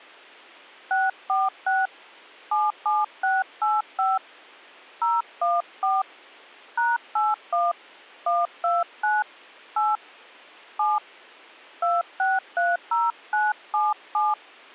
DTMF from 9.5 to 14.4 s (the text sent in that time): 8 7 2630977